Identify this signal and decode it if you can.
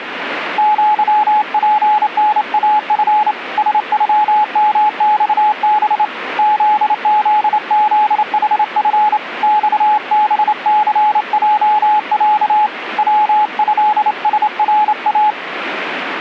Morse code (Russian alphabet), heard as a keyed tone, hand-sent with a straight key, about 28 wpm, 850 Hz, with radio static. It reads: ЪПНАФ СЮМЬБ ЗЗЗХФ ЬБЦЙЯ ВЭСРА